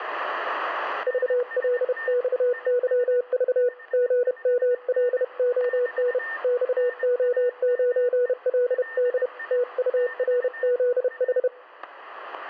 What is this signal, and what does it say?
Morse code, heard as a keyed tone, hand-sent with a paddle, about 31 wpm, 490 Hz, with static crashes and a weaker station near 1810 Hz. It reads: VLXYV GMLON XO9LD TURZH